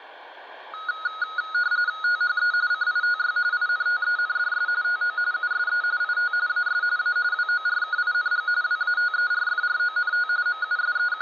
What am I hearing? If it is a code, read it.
RTTY (45.45 baud, 170 Hz shift), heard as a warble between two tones, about 1360 Hz centre, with room echo. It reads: THE CITY INTENDS TO USE IT AS A WORKING WATERFRONT …